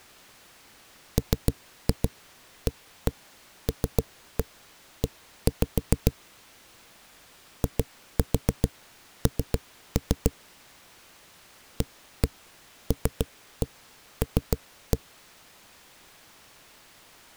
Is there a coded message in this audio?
Yes: tap code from 1.2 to 15.0 s, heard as knocks on a wall, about 7 knocks a second. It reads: MALE IN ALL